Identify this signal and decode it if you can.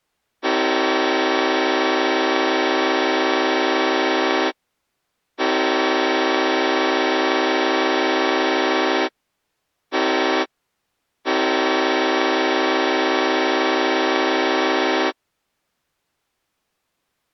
Train horn signal, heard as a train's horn. 2 long, 1 short, 1 long. On North American railways: approaching a public crossing.